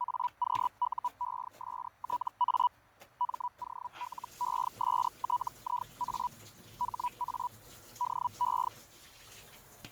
Hellschreiber (Feld-Hell, 122.5 baud), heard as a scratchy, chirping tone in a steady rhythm, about 980 Hz, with fading and kitchen noise. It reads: AQUESTA MOLESTIA HA DE